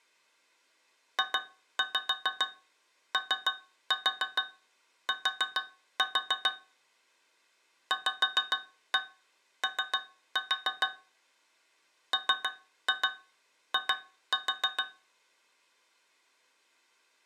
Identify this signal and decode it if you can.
Tap code, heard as taps on a metal pipe, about 6 knocks a second. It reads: JOT VO MI